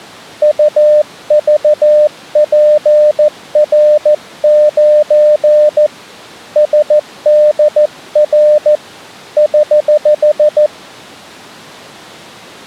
Morse code, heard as a keyed tone, hand-sent with a paddle, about 14 wpm, 600 Hz. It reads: UVPR9 SDR <HH>